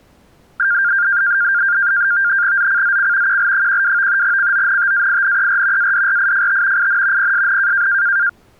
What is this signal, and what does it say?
NAVTEX (SITOR-B), 100 baud, 170 Hz shift, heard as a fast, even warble, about 1500 Hz centre. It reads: ZCZC QL12 CONTAINER ADRIFT IN PSN